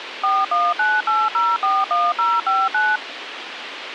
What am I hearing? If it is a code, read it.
DTMF, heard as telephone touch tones, dialled by machine, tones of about 220 ms, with radio hiss. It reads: 4198041059